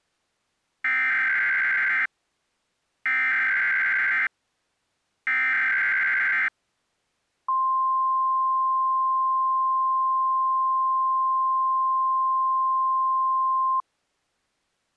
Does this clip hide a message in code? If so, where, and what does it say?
Yes: Emergency Alert System (SAME) tones (header bursts, then the 1050 Hz attention tone) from 0.8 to 13.8 s, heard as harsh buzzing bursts, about 520.83 baud.